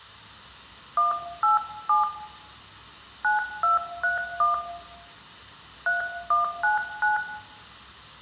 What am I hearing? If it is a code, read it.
DTMF, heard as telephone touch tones, dialled by hand, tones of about 140 ms, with room echo. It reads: 187 9231 3199